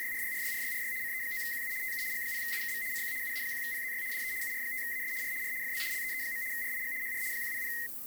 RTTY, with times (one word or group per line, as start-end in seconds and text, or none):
0.0-0.9 …
1.0-1.7 CE9QU
1.8-2.0 TU
2.1-2.8 G0UKV
2.9-3.1 CQ
3.2-4.0 UA1PZY
4.1-4.3 DE
4.4-5.1 UR5AS
5.2-5.3 R
5.4-5.5 R
5.6-5.8 FB
5.9-6.4 LEE.
6.5-6.9 RIG
7.0-7.2 HR
7.3-7.7 100